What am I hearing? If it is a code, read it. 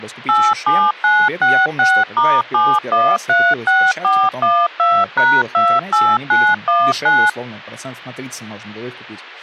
DTMF, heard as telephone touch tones, dialled by machine, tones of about 240 ms, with speech in Russian. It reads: 87966*7136412#28919